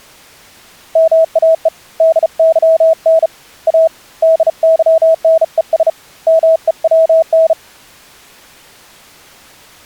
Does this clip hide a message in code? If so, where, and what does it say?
Yes: Morse code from 0.9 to 7.6 s, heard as a keyed tone, hand-sent with a bug key, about 35 wpm, 650 Hz. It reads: MAE DYN A DYNES MEWN